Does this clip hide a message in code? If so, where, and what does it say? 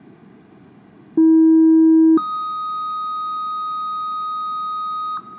Yes: two-tone page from 1.2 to 5.2 s, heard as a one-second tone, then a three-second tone, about 320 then 1250 Hz.